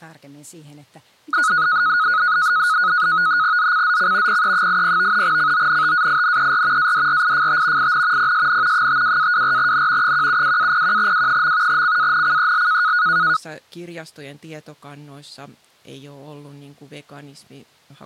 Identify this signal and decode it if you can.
NAVTEX (SITOR-B), 100 baud, 170 Hz shift, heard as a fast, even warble, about 1360 Hz centre, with speech in Finnish. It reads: ZCZC PE80 CONTAINER ADRIFT IN PSN 52-24N 172-01W. CANCEL